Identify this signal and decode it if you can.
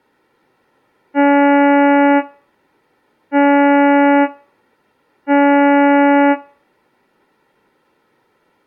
Ship horn signal, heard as a ship's horn, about 280 Hz, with room echo. 3 short. At sea: I am operating astern propulsion.